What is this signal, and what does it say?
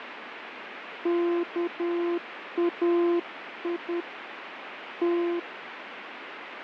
Morse code (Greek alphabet), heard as a keyed tone, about 10 wpm, 340 Hz, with radio static. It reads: ΚΑΙ Τ